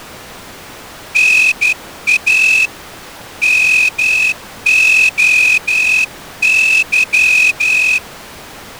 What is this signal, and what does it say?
Morse code (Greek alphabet), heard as a whistle, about 12 wpm. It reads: ΝΑ ΜΟΥ